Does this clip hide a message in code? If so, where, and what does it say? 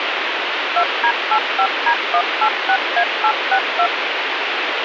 Yes: DTMF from 0.8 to 3.9 s, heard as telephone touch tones, dialled by machine, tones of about 80 ms, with radio hiss and a squelch burst at the end. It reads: 2D85D186A862